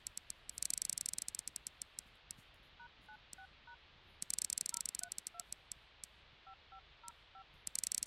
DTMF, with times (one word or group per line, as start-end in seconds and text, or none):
2.8-3.7 #96#
4.7-5.4 032
6.5-7.4 5505